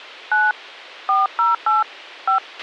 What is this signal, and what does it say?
DTMF, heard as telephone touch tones, dialled by hand, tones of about 150 ms, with a squelch burst at the end. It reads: 9 408 5